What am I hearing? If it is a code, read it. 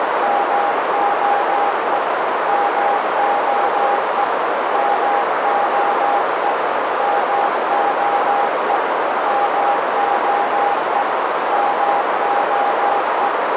Morse code, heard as a keyed tone, machine-sent, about 17 wpm, 810 Hz, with heavy radio static and a narrow filter. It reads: MOE MOE MOE MOE MOE MOE